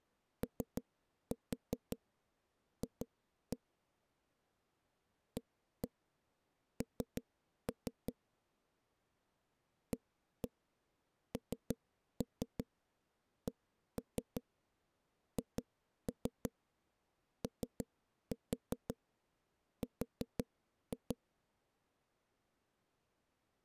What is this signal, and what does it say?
Tap code, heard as knocks on a wall, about 5 knocks a second. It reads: OF AN ANCHOR